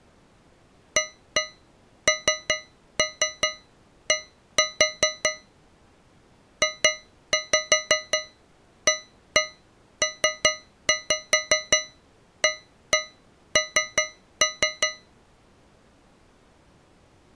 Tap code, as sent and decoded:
1-1 3-3 1-4 / 2-5 1-1 3-5 1-1 3-3
AND JAPAN

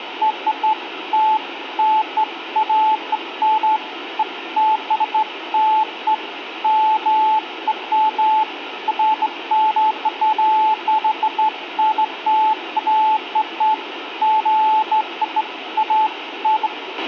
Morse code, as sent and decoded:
none

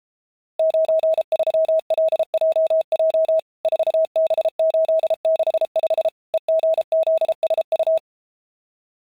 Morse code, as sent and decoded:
----. ...-- .-.. .--- .--- / ....- -... ---.. -.... ..... / . --. --.. ... ..-
93LJJ 4B865 EGZSU

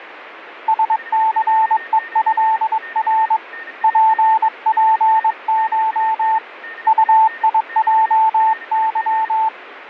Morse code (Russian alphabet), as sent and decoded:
... -.-. . ..-.. .-. / .--. .--. ---- / ..- .. .--- -.--
СЦЕЭР ППШ УИЙЫ

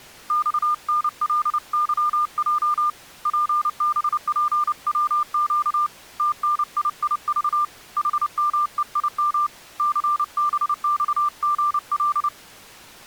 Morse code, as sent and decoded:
-..- -. .-.. -.-- .--- / .--. -... .--. .-- --.- / - -. .. .. ...- / .... -- . .. -- / -.-. -... -..- --. .-..
XNLYJ PBPWQ TNIIV HMEIM CBXGL

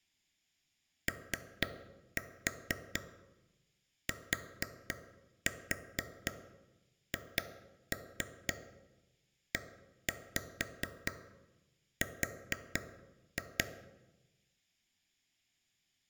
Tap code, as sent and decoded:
3-4 4-4 2-3 1-5 4-2
OTHER

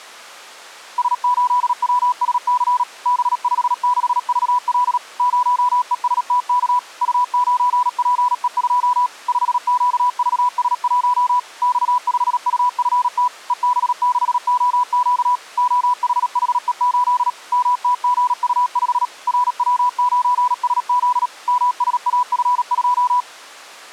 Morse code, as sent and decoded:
... ---.. .-- ... -.-. / -... ..... -.... ...- .-.. / ----- . ... - -.- / ..- ----. .--. . ..--- / ..... --.- ...- ... .---- / -..- ..... ..- ..-. - / . -... -.... --- --.- / --- .... .... . ---.. / -- - --. ..- ..... / .-. .-- ----. ... --.. / -- ... .- ..-. ..---
S8WSC B56VL 0ESTK U9PE2 5QVS1 X5UFT EB6OQ OHHE8 MTGU5 RW9SZ MSAF2

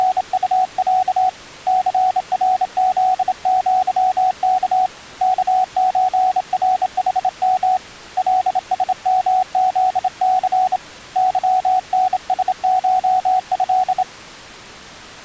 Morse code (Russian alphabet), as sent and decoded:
… / -.-. .-. --.. --.-- -.- / -.- ---. .-. .... -- / .-.. ... -- --.. -.-. / -.-- -. ... ---- ..-..
… ЦРЗЪК КЧРХМ ЛСМЗЦ ЫНСШЭ

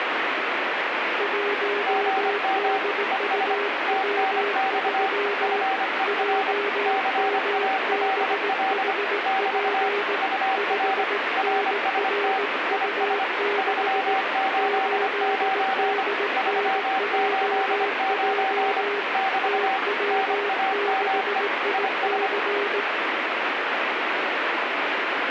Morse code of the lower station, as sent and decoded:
.---- -.. ..- .-- ...-- / .--- -- -... .... .--. / ..... -. .-. ..- -.... / ---.. -.. -. .--- .--- / - .-- -.... .. -.-.
1DUW3 JMBHP 5NRU6 8DNJJ TW6IC

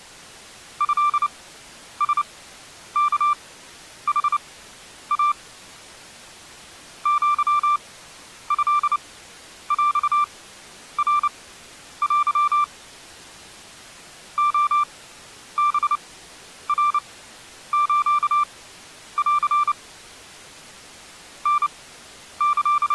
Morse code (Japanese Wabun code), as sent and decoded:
..-.. ... -.- .... .- / --.-- ..-.. .-..- .-. .-.-- / --- -... .-. ---.- .-.-. / …
トラワヌイ アトヰナテ レハナスン …

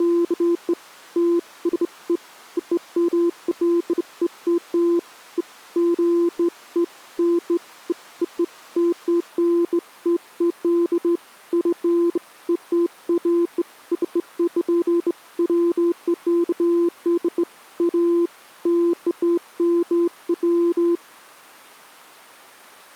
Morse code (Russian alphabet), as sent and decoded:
none

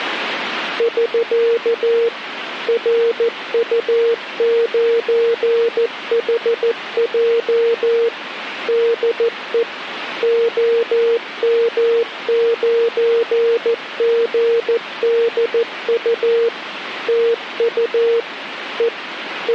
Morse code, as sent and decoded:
...-.- / .-. ..- ----. .... .--- / -.. . / --- -- ----. --. -.. ..- / - ..- / . / …
<SK> RU9HJ DE OM9GDU TU E …

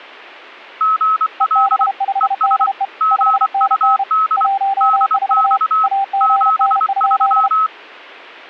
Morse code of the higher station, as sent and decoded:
--. .-.. / . ... / --. ..- -.. / -.. -..- / --... ...--
GL ES GUD DX 73

